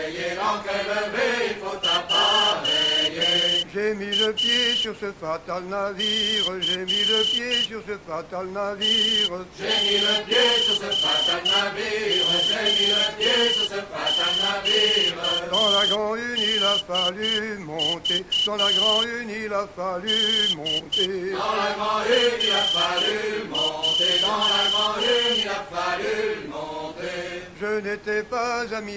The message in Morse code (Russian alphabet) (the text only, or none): ЙА Ц ТЧОЩДЖ Д РЙ